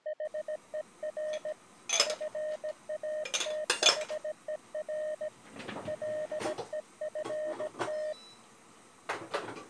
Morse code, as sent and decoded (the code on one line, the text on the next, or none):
.... . .-. / ..-. .- - .... . .-. / .-.. . ..-. -
HER FATHER LEFT